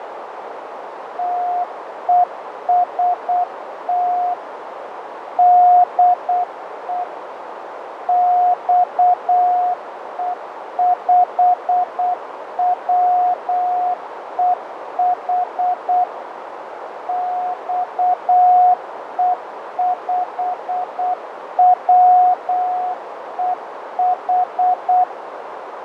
Morse code, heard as a keyed tone, machine-sent, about 8 wpm, 720 Hz, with radio static, fading and a narrow filter. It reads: TEST DE XE5WEH XE5WEH